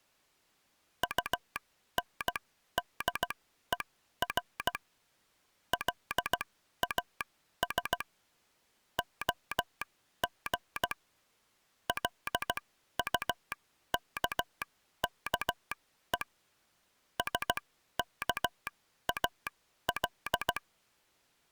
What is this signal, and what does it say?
Morse code, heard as a telegraph sounder, machine-sent, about 16 wpm, spaced as for 12 wpm. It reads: UNDER LAS OG LUKKE SKAL